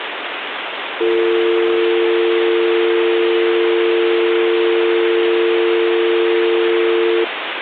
Telephone call progress tone (North American or UK plan), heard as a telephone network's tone, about 350, 450 Hz, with phone line noise. Dial tone.